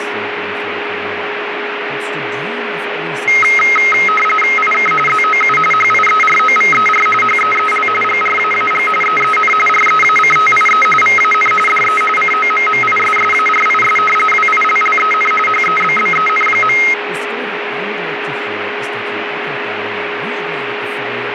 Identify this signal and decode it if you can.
RTTY (45.45 baud, 850 Hz shift), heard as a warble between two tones, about 1700 Hz centre, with radio static, a steady whistle near 410 Hz and speech in English. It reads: IK ZOU HIEROVER HEEL GRAAG EEN REACTIE VAN DE COMMISSARIS WILLEN HEBBEN.